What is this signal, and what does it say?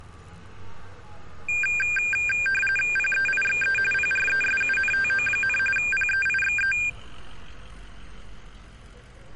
RTTY (45.45 baud, 850 Hz shift), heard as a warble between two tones, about 2000 Hz centre, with street noise. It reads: PEIXE PRESUNTO, PEIXE